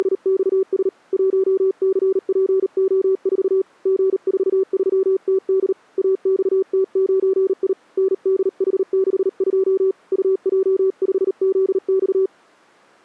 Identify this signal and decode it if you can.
Morse code, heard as a keyed tone, hand-sent with a paddle, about 38 wpm, 380 Hz. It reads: … 1CPO4 G43TD AXT9I NDH62 UJ5ZX